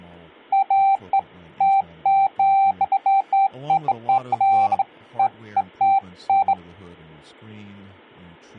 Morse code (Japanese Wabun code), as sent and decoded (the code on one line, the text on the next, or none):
none